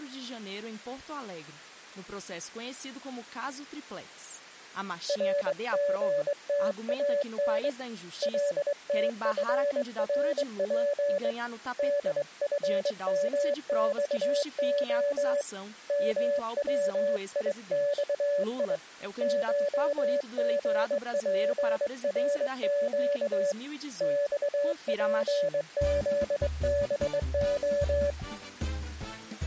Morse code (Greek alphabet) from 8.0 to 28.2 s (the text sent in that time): ΛΤΦΡΠ ΔΦΜΞΟ ΜΩΙΞΙ ΧΓΠΡΨ ΞΠΖΒΟ